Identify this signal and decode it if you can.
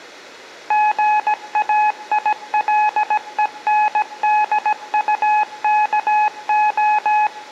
Morse code, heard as a keyed tone, machine-sent, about 17 wpm, 850 Hz, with room echo. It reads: GAILENDUKO